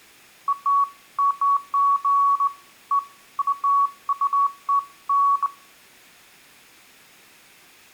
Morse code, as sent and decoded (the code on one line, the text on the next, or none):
none